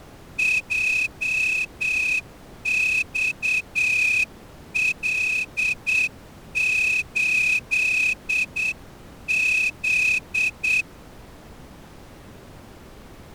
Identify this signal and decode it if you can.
Morse code, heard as a whistle, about 8 wpm. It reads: JXL8Z